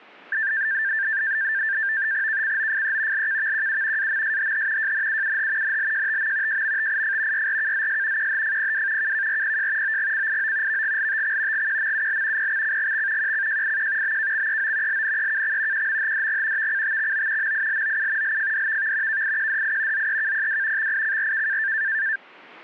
NAVTEX (SITOR-B), 100 baud, 170 Hz shift, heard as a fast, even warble, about 1700 Hz centre. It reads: KCOFE LKVQU AMSHH JNUUH NLJTM JMTIF YRKZS QHFPW KKRPJ OGCIO VGLTX GQMUL PXCGX QCJIQ BKXEO LNEKX QMHDG VCTXO MILOU LFDVV KIQDI ZEKPW XICRK